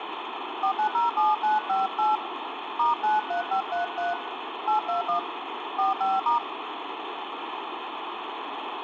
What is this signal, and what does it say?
DTMF, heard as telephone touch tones, dialled by hand, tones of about 140 ms, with phone line noise. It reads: 4907958 *93533 821 45*